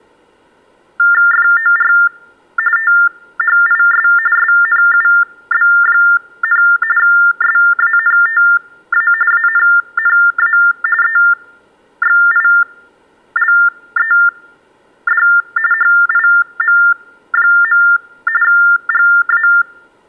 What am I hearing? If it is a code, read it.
TTY/TDD text telephone tones (45.45 baud Baudot), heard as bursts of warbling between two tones, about 400 Hz shift, 1600 Hz centre. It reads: FOR THIS SNUB, SANTA ANNA EXILED HIM. GA